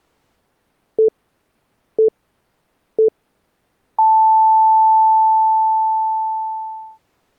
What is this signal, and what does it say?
Radio time signal (three low pips and a long one an octave up, as on NHK), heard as pips.